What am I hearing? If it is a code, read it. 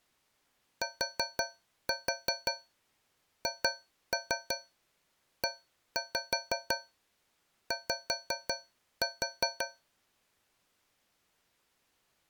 Tap code, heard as taps on a metal pipe, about 5 knocks a second. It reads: THEY